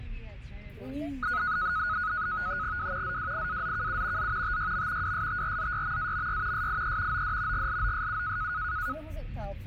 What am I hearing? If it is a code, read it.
NAVTEX (SITOR-B), 100 baud, 170 Hz shift, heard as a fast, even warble, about 1360 Hz centre, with the noise inside a car. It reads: W ZWIAZKU Z TYM WSTRZYMAMY SIE OD GLOSU